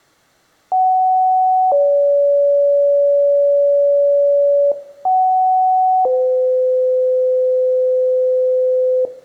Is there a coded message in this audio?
Yes: two-tone page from 0.7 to 9.1 s, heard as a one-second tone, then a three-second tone, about 750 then 570 Hz, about 750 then 510 Hz, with room echo.